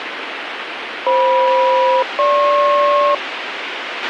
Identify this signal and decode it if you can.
Aircraft SELCAL, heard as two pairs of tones, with radio hiss and a squelch burst at the end. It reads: FM-GP